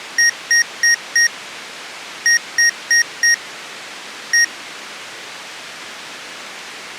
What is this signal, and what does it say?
Beep code, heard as beeps from a small speaker, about 1850 Hz. 4-4-1. In Phoenix BIOS tables: serial port failure.